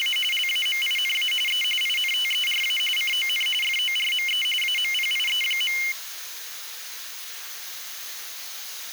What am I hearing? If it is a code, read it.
RTTY (45.45 baud, 850 Hz shift), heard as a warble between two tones, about 2550 Hz centre, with the noise of a restroom. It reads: … LAMINA E INTERA CON FORME AMPIE.